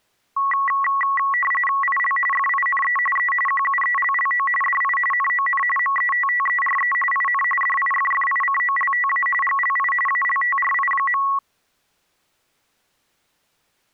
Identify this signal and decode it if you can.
RTTY (45.45 baud, 850 Hz shift), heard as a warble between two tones, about 1550 Hz centre. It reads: IL FINE E QUELLO DI NON METTERE IN DIFFICOLTA GLI ALTRI.